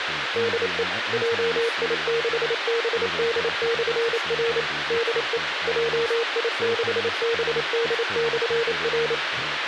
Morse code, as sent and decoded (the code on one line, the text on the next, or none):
-.. . / .--- .. -.... -... -.. -..-. .-. / -.. . / .--- .. -.... -... -.. -..-. .-.
DE JI6BD/R DE JI6BD/R